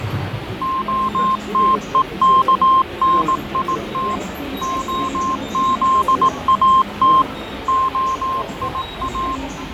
Morse code (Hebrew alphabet), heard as a keyed tone, machine-sent, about 18 wpm, 1060 Hz, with radio static, fading and the noise of a subway station. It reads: התוכנית הזאת היא